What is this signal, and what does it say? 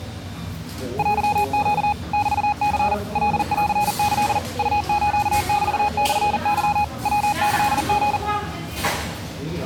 Morse code (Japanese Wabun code), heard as a keyed tone, machine-sent, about 40 wpm, 830 Hz, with the noise of a cafe. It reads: テネ メニ カンキ ウスメモケ ヤキリ